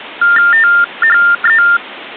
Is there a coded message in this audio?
Yes: TTY/TDD text telephone tones (45.45 baud Baudot) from 0.2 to 1.8 s, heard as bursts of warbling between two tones, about 400 Hz shift, 1600 Hz centre. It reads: THE